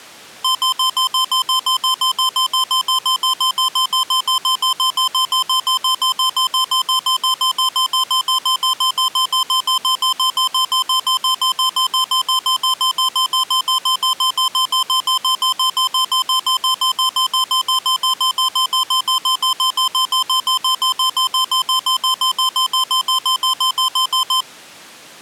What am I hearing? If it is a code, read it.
Evenly repeated beeps. There is no code.